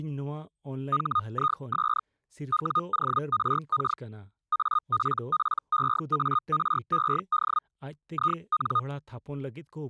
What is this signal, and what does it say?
Hellschreiber (Feld-Hell, 122.5 baud), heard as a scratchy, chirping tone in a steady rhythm, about 1230 Hz, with speech in Santali. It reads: HIS WORK APPEARED IN